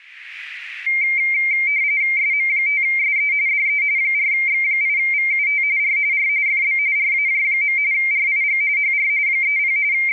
RTTY (45.45 baud, 170 Hz shift), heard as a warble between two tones, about 2200 Hz centre. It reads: SM5SE DE 4X8VUT R R FB RAJ. RIG HR 30 …